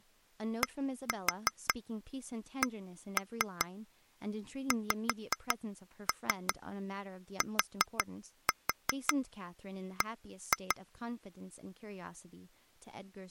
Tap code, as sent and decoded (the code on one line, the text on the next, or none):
1-4 1-3 5-3 4-4 1-2
DCXTB